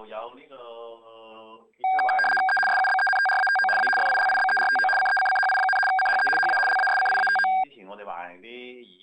RTTY (75 baud, 850 Hz shift), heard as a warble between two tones, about 1180 Hz centre. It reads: E SUBENTRATO A FILIBERTO CECCHI, CHE HA LASCIATO